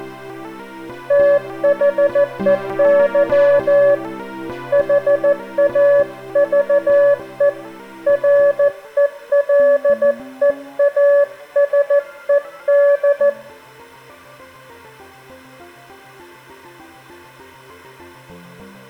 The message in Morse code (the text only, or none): THEY HAVE RELEASED